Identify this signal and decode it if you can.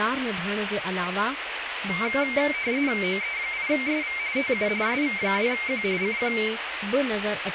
RTTY (45.45 baud, 170 Hz shift), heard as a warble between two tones, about 2200 Hz centre, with radio static and speech in Sindhi. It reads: OE8SV TU SV2Q CQ